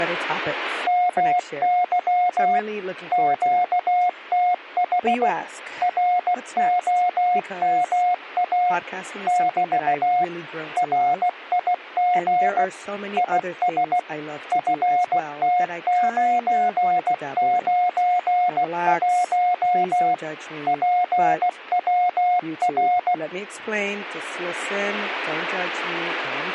Morse code, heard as a keyed tone, machine-sent, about 16 wpm, 720 Hz, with speech in English. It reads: MY QTH ROMA <BT> RIG IS FT991 PWR